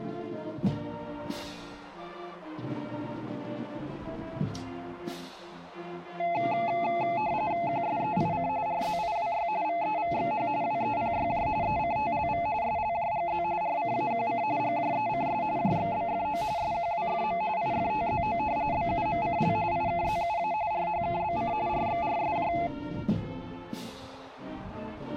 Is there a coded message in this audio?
Yes: RTTY (45.45 baud, 170 Hz shift) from 6.2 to 22.7 s, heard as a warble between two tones, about 770 Hz centre. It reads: QSEIC RZIWY VEVXH WEPYJ ECTLV SLJGZ RCAQC GJECS JXBFO SQWFM IFTZO BUMCL IKZUA RHKBC RXRSJ